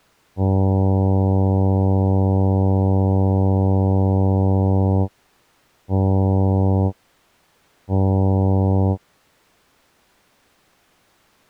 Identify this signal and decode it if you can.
Ship horn signal, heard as a ship's horn, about 100 Hz. 1 long, 2 short. At sea: a vessel in fog that is sailing, fishing, towing or hampered.